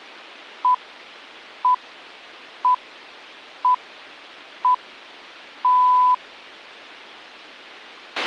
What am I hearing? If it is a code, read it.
Radio time signal (six pips, as the Greenwich Time Signal), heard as pips, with a squelch burst at the end.